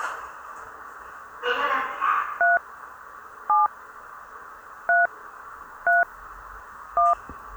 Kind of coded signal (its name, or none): DTMF